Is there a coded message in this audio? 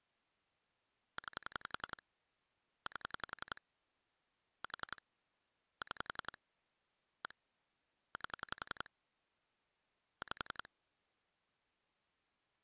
Yes: pulse dialling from 1.2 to 10.7 s, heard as clicks on a phone line, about 11 pulses a second. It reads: 9 8 4 6 1 8 5